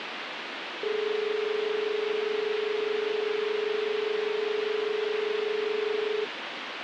Telephone call progress tone (as in Australia), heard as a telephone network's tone, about 430 Hz, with phone line noise. Dial tone.